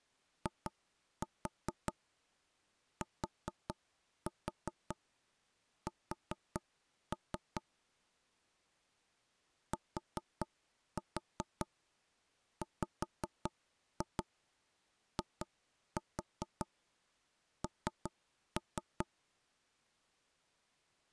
Tap code, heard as knocks on wood, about 5 knocks a second. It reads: ITS TWIN